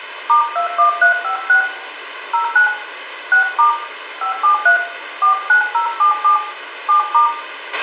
DTMF, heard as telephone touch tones, dialled by hand, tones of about 120 ms, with radio hiss, a squelch burst at the end and room echo. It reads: *21356 09 6* 573 49077 7*